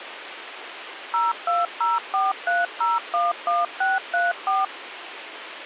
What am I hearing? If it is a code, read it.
DTMF, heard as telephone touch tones, dialled by machine, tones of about 180 ms, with phone line noise. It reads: 02043011634